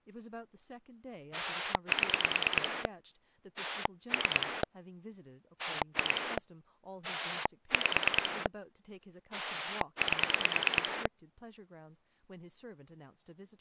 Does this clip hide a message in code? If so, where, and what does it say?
Yes: pulse dialling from 1.3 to 11.1 s, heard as a rotary dial, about 9 pulses a second, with speech in English. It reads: 7 3 2 5 8